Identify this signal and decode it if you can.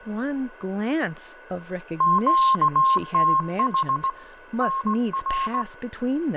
Morse code, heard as a keyed tone, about 18 wpm, 1070 Hz, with radio static, fading, a steady whistle near 1480 Hz and speech in English. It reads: QTH NR